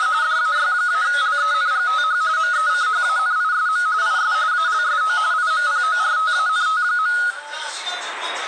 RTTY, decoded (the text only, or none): … DAY-LENGTH MECHANISM IS ALSO IMPORTANT.